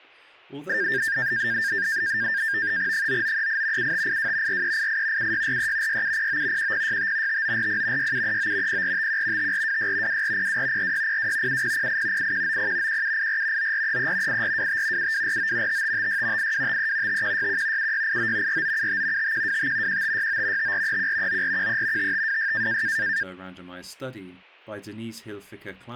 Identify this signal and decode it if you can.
NAVTEX (SITOR-B), 100 baud, 170 Hz shift, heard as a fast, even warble, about 1700 Hz centre, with speech in English. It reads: 9938 7582 4388 7643 6709 1065 5940 6739 0451 5426 2402 4602 7008 8190 1784 9433 8425 7249 5556 8253 5161 7689 4975 5125 1569 5431 9413 5526